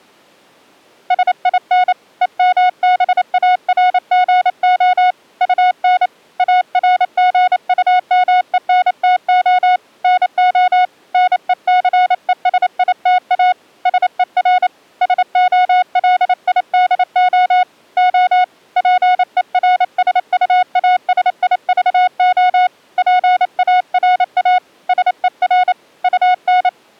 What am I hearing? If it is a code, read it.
Morse code, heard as a keyed tone, hand-sent with a paddle, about 28 wpm, 730 Hz. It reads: SIN EMBARGO UN ARGUMENTO NO NECESITA SER SOLIDO O PERSUASIVO PARA SER UN